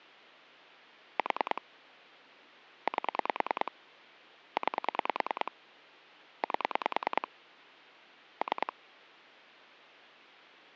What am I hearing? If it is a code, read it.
Pulse dialling, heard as clicks on a phone line, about 10 pulses a second. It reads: 4 8 9 8 3